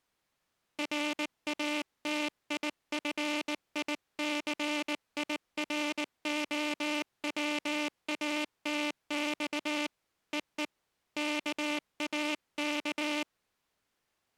Morse code (Russian alphabet), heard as a buzzer, hand-sent with a bug key, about 19 wpm. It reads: РАТИФИЦИРОВАТЬ ЕЕ КАК